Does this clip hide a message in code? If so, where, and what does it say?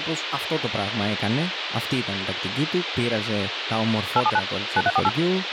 Yes: DTMF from 4.2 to 5.1 s, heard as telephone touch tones, dialled by machine, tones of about 40 ms, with radio hiss and speech in Greek. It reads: 879 9348